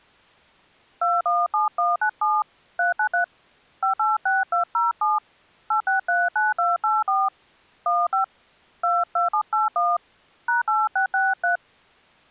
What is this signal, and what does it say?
DTMF, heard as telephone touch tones, dialled by hand, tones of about 150 ms. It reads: 217197 393 586207 8639284 15 22781 #8663